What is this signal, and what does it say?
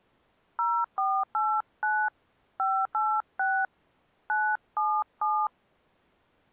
DTMF, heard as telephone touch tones, dialled by hand, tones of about 260 ms. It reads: 0489 586 977